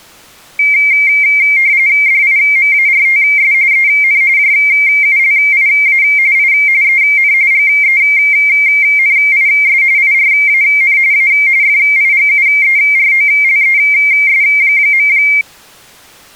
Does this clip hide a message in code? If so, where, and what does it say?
Yes: RTTY (45.45 baud, 170 Hz shift) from 0.6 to 15.4 s, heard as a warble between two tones, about 2200 Hz centre. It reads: DIMARTS EN JULIA I EN GENIS IRAN A FIGUEROLES.